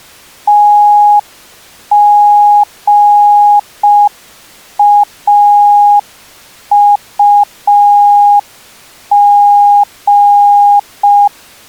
Morse code, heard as a keyed tone, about 5 wpm, 820 Hz. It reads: TGAUG